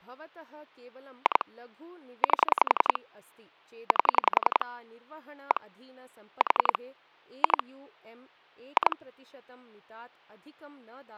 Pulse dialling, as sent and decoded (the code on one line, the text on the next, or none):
2 / 8 / 8 / 1 / 4 / 2 / 2
2 8 8 1 4 2 2